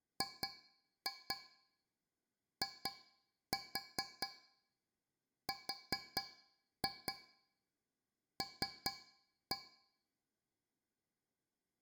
Tap code, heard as taps on a metal pipe, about 4 knocks a second, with room echo. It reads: GIRL